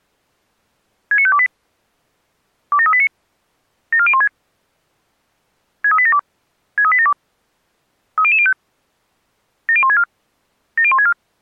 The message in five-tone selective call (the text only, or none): 69528 27389 74016 63872 63872 30005 70164 70164